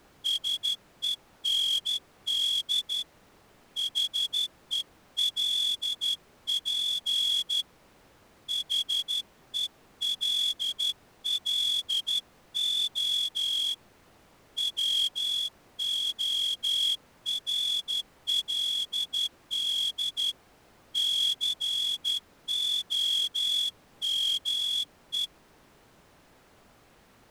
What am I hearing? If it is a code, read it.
Morse code, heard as a whistle, hand-sent with a straight key, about 12 wpm. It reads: SEND HELP HELLO WORLD COME